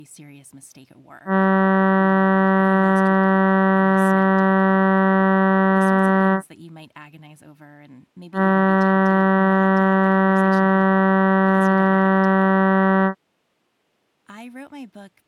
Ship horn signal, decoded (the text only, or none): 2 long